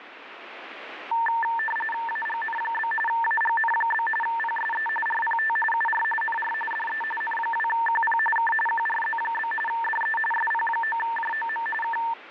RTTY (45.45 baud, 850 Hz shift), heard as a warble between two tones, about 1340 Hz centre, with radio static. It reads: AGN? AGN? PSE RPT UR NR DE N2QP K QRZ? DE SP9JOM K